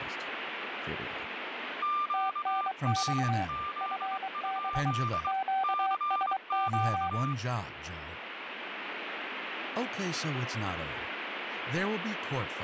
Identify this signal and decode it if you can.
Morse code, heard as two keyed tones, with radio static and speech in English. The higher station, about 22 wpm, 1190 Hz: QRZ? CQ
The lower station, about 23 wpm, 770 Hz: TNX FB QSO